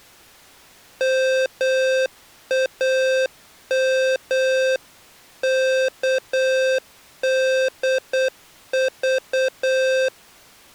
Morse code (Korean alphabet), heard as electronic beeps, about 8 wpm, 520 Hz. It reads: 몸을